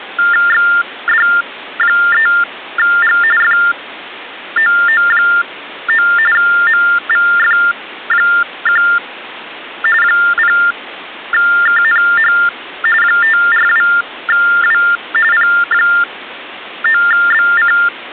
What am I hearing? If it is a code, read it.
TTY/TDD text telephone tones (45.45 baud Baudot), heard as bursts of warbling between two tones, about 400 Hz shift, 1600 Hz centre. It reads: XD3G FOO9 MVF1 0KNH 542W P9BC